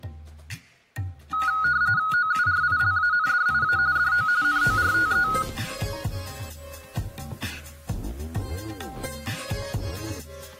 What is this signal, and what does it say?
RTTY (45.45 baud, 170 Hz shift), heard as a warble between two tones, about 1360 Hz centre, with room echo. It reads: OURILANDIA DO NORTE